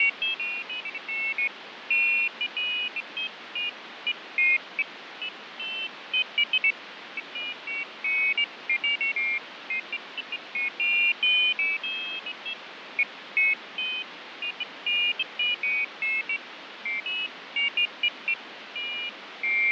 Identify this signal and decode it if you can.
Pairs of high tones at irregular times, with radio static and fading. There is no code.